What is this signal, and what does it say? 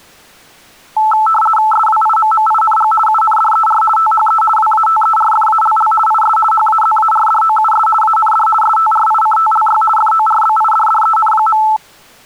RTTY (50 baud, 450 Hz shift), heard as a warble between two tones, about 1090 Hz centre. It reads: SWIMMING UNDER THE WATERFALL IS HAZARDOUS AND STRICTLY FORBIDDEN.